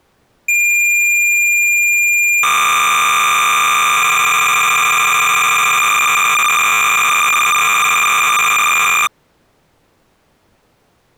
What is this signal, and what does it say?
Cassette data (Kansas City type), 300 baud, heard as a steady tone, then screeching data.